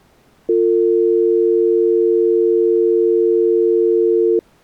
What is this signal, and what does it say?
Telephone call progress tone (North American or UK plan), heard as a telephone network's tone, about 350, 450 Hz. Dial tone.